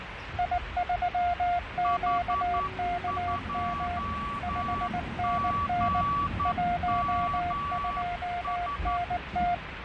Morse code, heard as two keyed tones, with radio static, fading and the noise of a residential street. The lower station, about 19 wpm, 700 Hz: I3QKM 5NN 12NT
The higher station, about 11 wpm, 1140 Hz: H2GMS